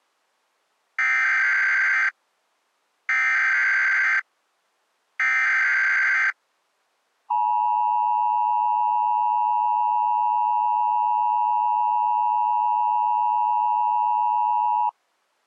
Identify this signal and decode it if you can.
Emergency Alert System (SAME) tones (header bursts, then the 853 and 960 Hz attention tone), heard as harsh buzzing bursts, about 520.83 baud.